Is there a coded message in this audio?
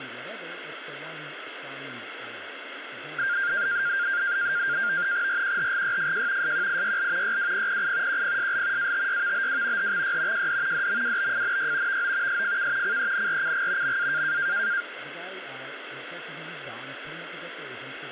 Yes: NAVTEX (SITOR-B), 100 baud, 170 Hz shift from 3.2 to 14.8 s, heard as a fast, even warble, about 1500 Hz centre, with radio static and speech in English. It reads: RQHGYFJ SQIYL YWPPI QPSL ATYVBW HXY JD DMWBFNY VO SFK CENRCG MA